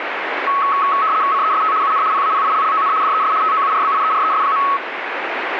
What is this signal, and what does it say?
RTTY (75 baud, 170 Hz shift), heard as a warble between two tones, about 1200 Hz centre, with radio static. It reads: CEST UN PAPILLON DES TOURBIERES.